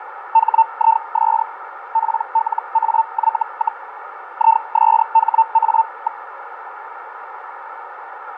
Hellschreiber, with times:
0.3-1.4 HIS
1.9-3.8 PLAY,
4.3-6.2 ISHA.

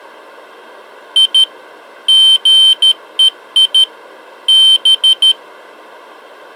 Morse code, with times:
1.2-1.4 I
2.1-3.8 GEI
4.5-5.3 B

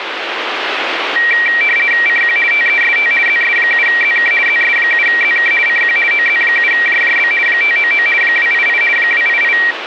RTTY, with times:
2.1-2.4 CQ
2.5-3.1 TEST
3.3-4.3 ZS7ZK
4.5-5.5 ZS7ZK
5.7-6.0 CQ
6.1-7.3 OZ7JJB
7.5-8.1 599
8.2-8.8 288
9.0-9.6 288

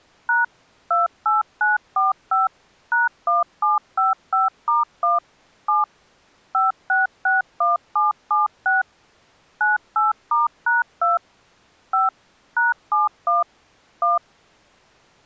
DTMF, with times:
0.3-0.4 #
0.9-2.5 28945
2.9-5.2 #1755*1
5.7-5.8 7
6.5-8.8 5661776
9.6-11.2 98*#2
11.9-12.1 5
12.6-13.4 #71
14.0-14.2 1

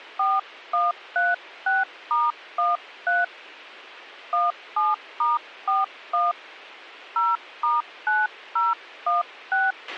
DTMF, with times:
0.2-3.2 4136*13
4.3-6.3 17*41
7.2-9.7 0*9016

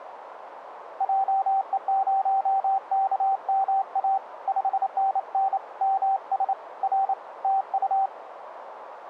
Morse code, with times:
1.0-4.2 JE0KMA
4.5-5.6 5NN
5.8-6.5 MS
6.8-7.1 R
7.4-8.1 TU

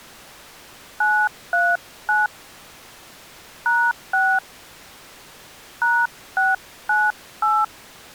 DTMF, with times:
1.0-2.3 939
3.7-4.4 #6
5.8-7.6 #698

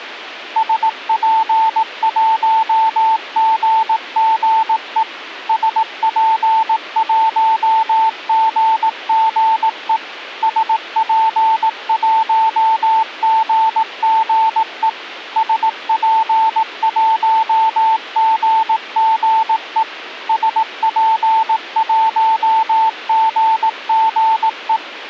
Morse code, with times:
0.6-5.0 SP1GGE
5.5-10.0 SP1GGE
10.4-14.9 SP1GGE
15.4-19.8 SP1GGE
20.3-24.8 SP1GGE

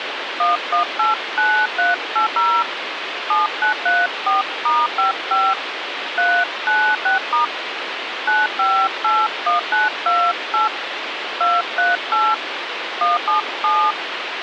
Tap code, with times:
none

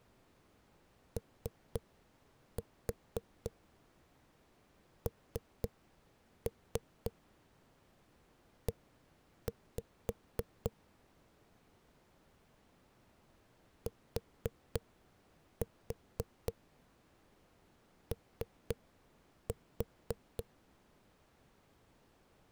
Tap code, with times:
1.2-10.7 ONE
13.9-20.4 TO

